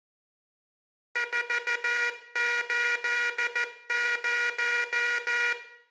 Morse code, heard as a buzzer, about 14 wpm, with room echo. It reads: 480